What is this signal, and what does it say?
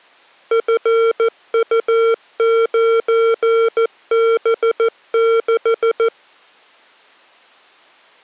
Morse code, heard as electronic beeps, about 14 wpm, 460 Hz. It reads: FU9B6